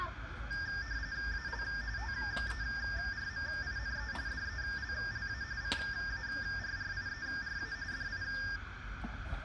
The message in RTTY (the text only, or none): AL TERMINE DELLA CARRIERA DI